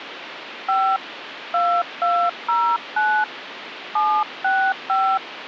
DTMF, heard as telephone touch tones, dialled by hand, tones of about 280 ms, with phone line noise. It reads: 5 2209 765